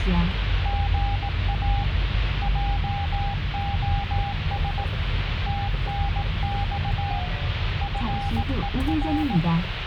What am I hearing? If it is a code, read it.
Morse code, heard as a keyed tone, hand-sent with a paddle, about 18 wpm, 800 Hz, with radio static and the noise inside a car. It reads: GA JOS TNX FER